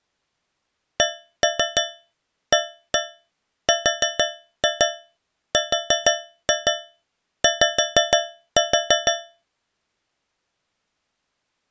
Tap code, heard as taps on a metal pipe, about 6 knocks a second. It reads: CARRY